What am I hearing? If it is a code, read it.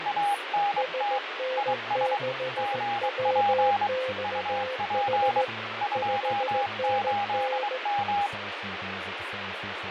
Morse code, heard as two keyed tones, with radio static and speech in English. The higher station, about 23 wpm, 810 Hz: ANT IS GP UP 28M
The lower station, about 16 wpm, 520 Hz: SN6WXH 5NN